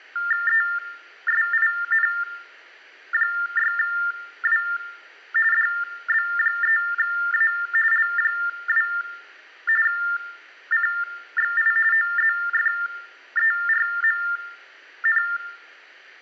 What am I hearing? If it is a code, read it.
TTY/TDD text telephone tones (45.45 baud Baudot), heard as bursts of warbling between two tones, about 400 Hz shift, 1600 Hz centre, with room echo. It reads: ESIN6W DB3A L2 CXI OZFERMN